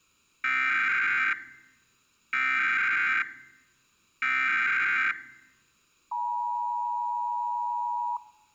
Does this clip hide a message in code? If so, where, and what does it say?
Yes: Emergency Alert System (SAME) tones (header bursts, then the 853 and 960 Hz attention tone) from 0.4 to 8.2 s, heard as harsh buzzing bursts, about 520.83 baud.